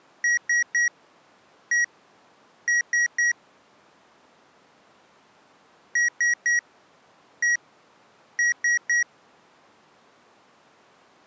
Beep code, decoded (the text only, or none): 3-1-3